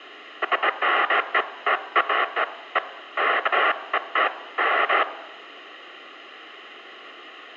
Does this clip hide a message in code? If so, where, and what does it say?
No, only bursts of noise, with radio hiss and room echo.